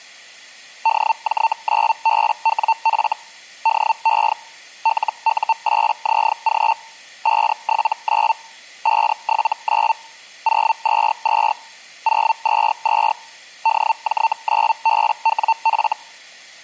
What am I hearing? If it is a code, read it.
Hellschreiber (Feld-Hell, 122.5 baud), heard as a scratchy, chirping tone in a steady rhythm, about 900 Hz. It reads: DJ9BWF DE LU8ZG 579 579 022 022 DJ9BWF